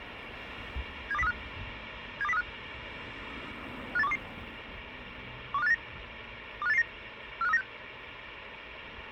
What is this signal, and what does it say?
Five-tone selective call (EEA), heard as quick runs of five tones, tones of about 40 ms, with radio hiss and street noise. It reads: 72035 72035 58122 12589 25889 45396